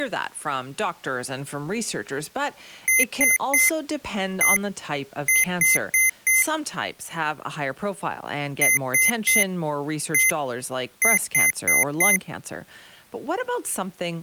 Beep code, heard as beeps from a small speaker, played twice, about 2050 Hz, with speech in English. 3-1-4. In Phoenix BIOS tables: interrupt mask register failure.